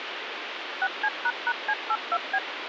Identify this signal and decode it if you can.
DTMF, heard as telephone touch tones, dialled by machine, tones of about 60 ms, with phone line noise. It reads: 6C##C82B